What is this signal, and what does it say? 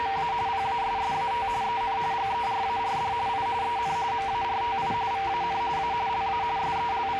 RTTY (45.45 baud, 170 Hz shift), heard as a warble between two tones, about 870 Hz centre, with radio static, a steady whistle near 450 Hz and the noise of a cafe. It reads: … PASSAT EN GERARD I EN MARTI VAN A LA …